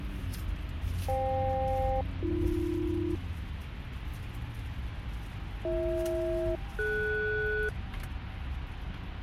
Aircraft SELCAL, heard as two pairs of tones, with the noise inside a car. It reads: FK-AB BH-DS